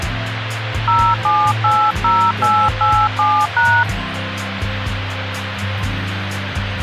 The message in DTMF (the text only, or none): 0780887#